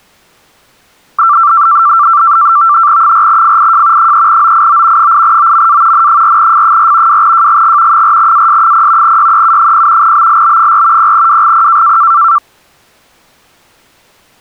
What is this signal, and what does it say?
NAVTEX (SITOR-B), 100 baud, 170 Hz shift, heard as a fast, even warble, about 1260 Hz centre. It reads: 4FIJ 3OIO 8OMA N4F4 2JGG 4AS0 YEU0 BLB4 0WGP